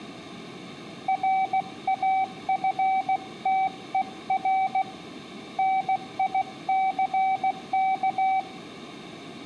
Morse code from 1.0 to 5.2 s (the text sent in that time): RAFTER